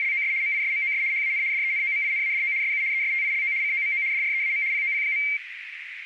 RTTY (75 baud, 170 Hz shift), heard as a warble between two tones, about 2200 Hz centre, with radio static and a narrow filter. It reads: … MISMOS HAN DENOMINADO SU ESTILO COMO DREAM POP.